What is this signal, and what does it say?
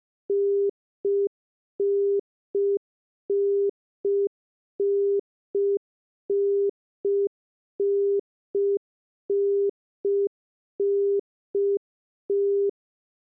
Telephone call progress tone (UK plan), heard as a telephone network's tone, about 400 Hz. Congestion tone.